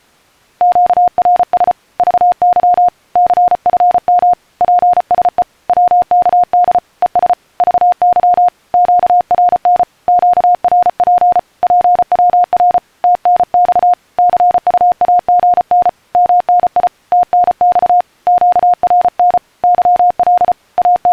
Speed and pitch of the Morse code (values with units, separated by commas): 34 wpm, 710 Hz